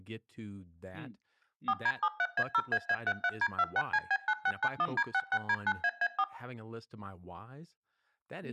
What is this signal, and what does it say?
DTMF, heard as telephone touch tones, dialled by machine, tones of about 60 ms, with room echo and speech in English. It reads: 4D73A0AA33D26CB9691D66D9AA4